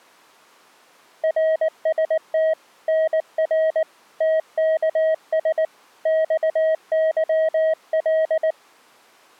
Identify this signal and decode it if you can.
Morse code, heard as a keyed tone, hand-sent with a paddle, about 19 wpm, 640 Hz. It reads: RST NR TKS XYL